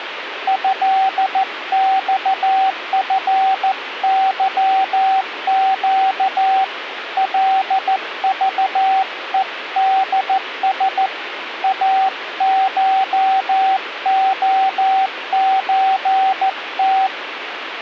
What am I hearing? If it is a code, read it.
Morse code (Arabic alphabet), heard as a keyed tone, hand-sent with a paddle, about 14 wpm, 770 Hz, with radio static. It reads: هصفظق لضءدس اشخزت